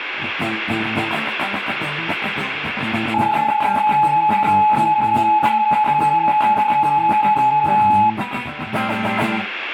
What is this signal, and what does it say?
PSK31 (31.25 baud), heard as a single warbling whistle, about 850 Hz.